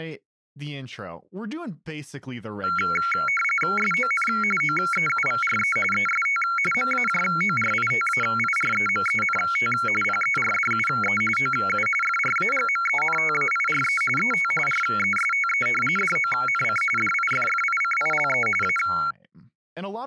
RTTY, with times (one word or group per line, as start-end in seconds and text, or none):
3.8-4.3 SON
4.6-5.8 OEUVRE
5.9-6.4 EST
6.7-9.7 MAJORITAIREMENT
10.0-11.2 PERDUE
11.4-11.9 OU
12.0-14.0 FRAGMENTAIRE
14.2-14.5 ET
14.7-15.7 RESTE
16.0-16.8 DONC
17.0-18.5 DIFFICILE
18.6-18.8 A